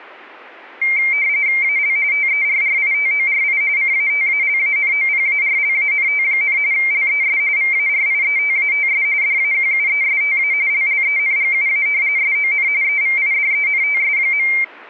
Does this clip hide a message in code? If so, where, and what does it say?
Yes: RTTY (45.45 baud, 170 Hz shift) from 0.8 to 14.6 s, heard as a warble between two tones, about 2200 Hz centre. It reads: AL TERRITORI CATALANOPARLANT, LES VARIETATS DAQUESTA LLENGUA SON EVIDENTS.